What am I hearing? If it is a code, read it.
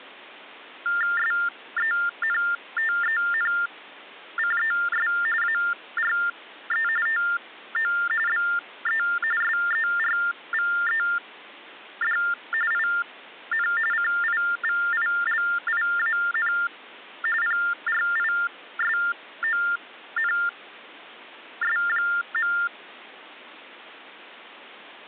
TTY/TDD text telephone tones (45.45 baud Baudot), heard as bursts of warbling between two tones, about 400 Hz shift, 1600 Hz centre. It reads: SENTENCES ARE TO BE SERVED IN CIVILIAN PRISONS.